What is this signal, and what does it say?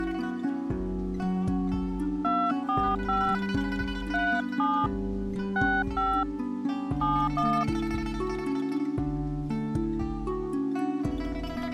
DTMF, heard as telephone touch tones, dialled by hand, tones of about 270 ms. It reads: 245 37 65 71